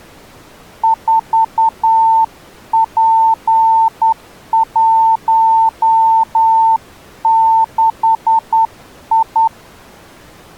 Morse code, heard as a keyed tone, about 10 wpm, 900 Hz. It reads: 4P16I